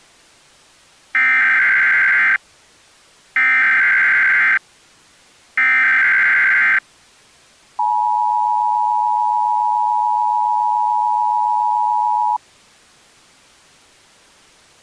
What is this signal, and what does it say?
Emergency Alert System (SAME) tones (header bursts, then the 853 and 960 Hz attention tone), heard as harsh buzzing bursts, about 520.83 baud.